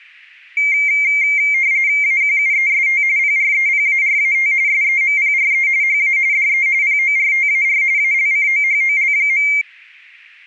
RTTY (45.45 baud, 170 Hz shift), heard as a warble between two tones, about 2200 Hz centre. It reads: AQUEST PREPARAT SEMPRE HA DE PORTAR ALCOHOL.